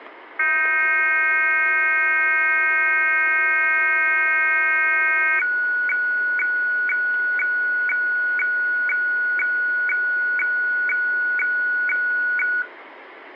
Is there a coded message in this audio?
Yes: weather fax (radiofax), 120 lines a minute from 0.4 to 12.6 s, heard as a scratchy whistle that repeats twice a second.